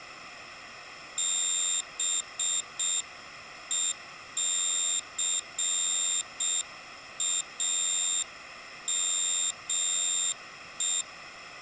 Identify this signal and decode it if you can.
Morse code, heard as a high beeper, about 6 wpm, 3650 Hz. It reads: BECAME